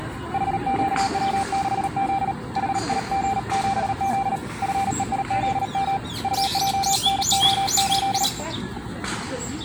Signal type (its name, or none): Morse code